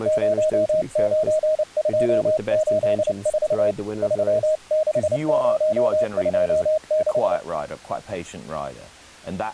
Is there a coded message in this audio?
Yes: Morse code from 0.0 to 7.4 s, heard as a keyed tone, hand-sent with a paddle, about 29 wpm, 620 Hz, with speech in English. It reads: 09284 36026